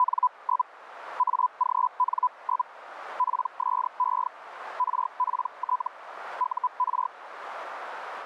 Hellschreiber (Feld-Hell, 122.5 baud), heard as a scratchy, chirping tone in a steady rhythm, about 1000 Hz, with radio static and a narrow filter. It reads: … AGN? PSE RPT UR